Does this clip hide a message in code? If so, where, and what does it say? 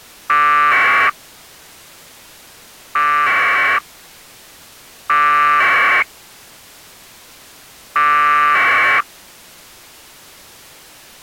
Yes: packet radio (AX.25, as in APRS), 1200 baud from 0.3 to 9.0 s, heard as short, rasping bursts.